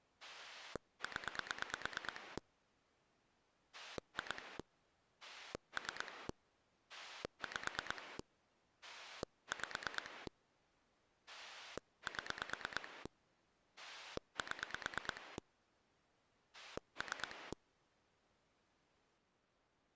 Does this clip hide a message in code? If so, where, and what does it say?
Yes: pulse dialling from 0.2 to 17.5 s, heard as a rotary dial, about 9 pulses a second. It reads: 0 2 3 5 5 7 7 3